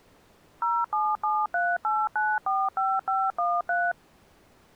DTMF, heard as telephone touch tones, dialled by machine, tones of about 220 ms. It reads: 07738945513